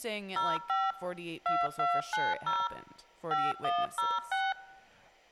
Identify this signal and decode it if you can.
DTMF, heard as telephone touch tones, dialled by machine, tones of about 210 ms, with speech in English. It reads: 05 2290 5106